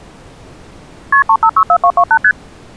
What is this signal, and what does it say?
Multi-frequency trunk signalling (R1, as on North American trunks), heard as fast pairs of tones, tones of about 70 ms. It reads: KP 3564228 ST